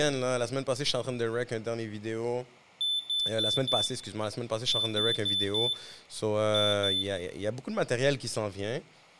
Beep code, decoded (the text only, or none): 4-4-2